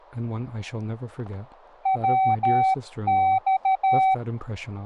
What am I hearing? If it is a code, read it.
Morse code, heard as a keyed tone, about 13 wpm, 760 Hz, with static crashes and speech in English. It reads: WX